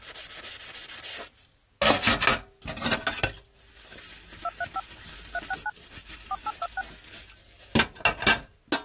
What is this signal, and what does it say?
DTMF, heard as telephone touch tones, dialled by machine, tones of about 40 ms, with kitchen noise. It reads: 235 369 4826